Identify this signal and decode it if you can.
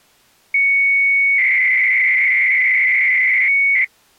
300-baud modem data (Bell 103 tones), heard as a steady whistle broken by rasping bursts, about 300 baud, 200 Hz shift.